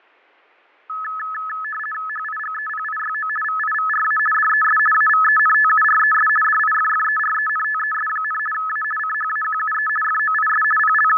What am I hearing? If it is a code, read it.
RTTY (50 baud, 450 Hz shift), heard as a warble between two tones, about 1500 Hz centre, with fading. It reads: HIGEPIYO VIVRA DES AVENTURES DIFFERENTES, A CHAQUE FOIS …